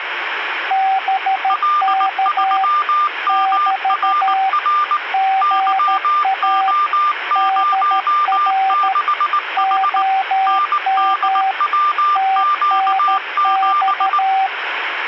Morse code, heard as two keyed tones, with radio static. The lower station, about 13 wpm, 770 Hz: BK <BT> GA DR OM TNX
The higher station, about 19 wpm, 1190 Hz: L3MRR YO06H NDWQ7